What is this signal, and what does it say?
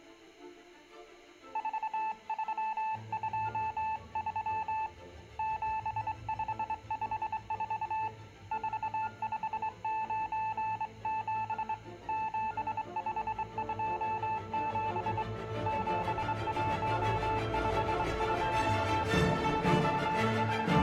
Morse code, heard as a keyed tone, hand-sent with a straight key, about 23 wpm, 880 Hz, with room echo. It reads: 4323 7554 4597 7527 7152 …